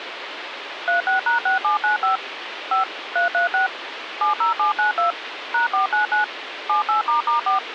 DTMF, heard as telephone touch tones, dialled by machine, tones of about 130 ms, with phone line noise. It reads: 36#6795 5 336 70792 #499 78**4